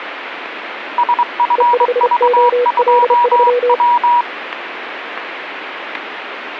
Morse code, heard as two keyed tones, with radio static. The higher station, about 23 wpm, 960 Hz: SFV2W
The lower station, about 32 wpm, 490 Hz: E5OL3